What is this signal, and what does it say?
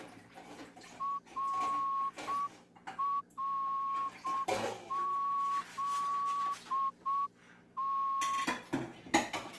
Morse code, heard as a whistle, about 7 wpm, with kitchen noise. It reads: RRZT